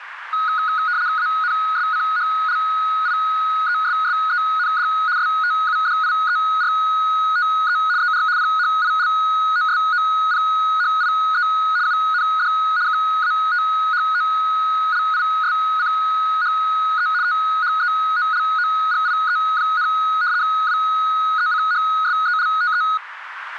RTTY (75 baud, 170 Hz shift), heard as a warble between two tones, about 1360 Hz centre, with radio static and a narrow filter. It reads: ANSCHLIESSEND STUDIERTE ER PHILOSOPHIE UND KATHOLISCHE THEOLOGIE, WECHSELTE